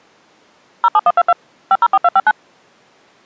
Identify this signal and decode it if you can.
DTMF, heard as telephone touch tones, dialled by machine, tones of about 40 ms. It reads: 07122 504259